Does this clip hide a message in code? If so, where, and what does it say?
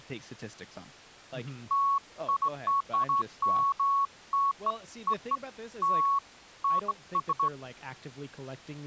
No, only beeps of irregular length, with speech in English.